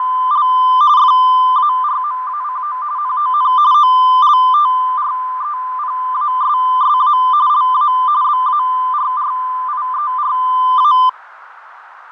RTTY (45.45 baud, 170 Hz shift), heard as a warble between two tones, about 1100 Hz centre, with radio static, fading and a narrow filter. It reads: … FARMACO NON OLTREPASSA LA BARRIERA